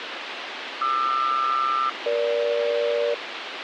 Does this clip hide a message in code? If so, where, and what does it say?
Yes: aircraft SELCAL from 0.8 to 3.1 s, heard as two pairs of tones, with radio hiss. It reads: QR-EG